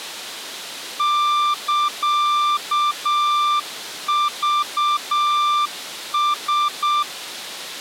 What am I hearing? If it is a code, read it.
Morse code (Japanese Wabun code), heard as a keyed tone, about 7 wpm, 1180 Hz. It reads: サクラ